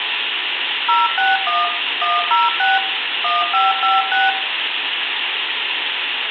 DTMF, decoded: 061 106 1556

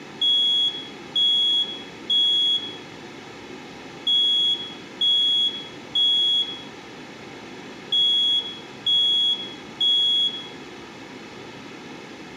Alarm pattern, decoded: temporal three

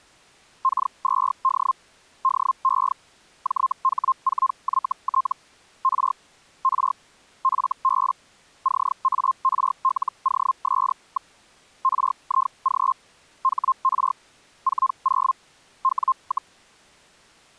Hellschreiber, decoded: K2D DE JH4YT R R FB CARLOS. RIG HR 40 W,

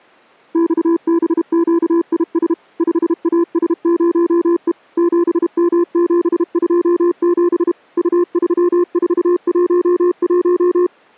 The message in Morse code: XBQIS 5AS0E 7M727 U3411

